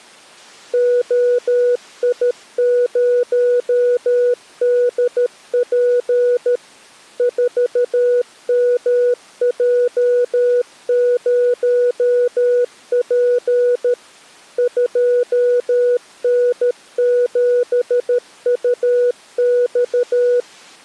Morse code, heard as a keyed tone, machine-sent, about 13 wpm, 490 Hz. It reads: OI0DP 4MJ0P 2N7UX